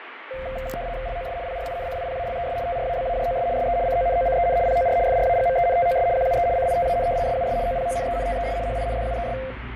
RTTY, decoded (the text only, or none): LOS PRINCIPALES TRABAJOS SE CONOCEN POR FRAGMENTOS QUE CITAN SUS OPONENTES HINDUES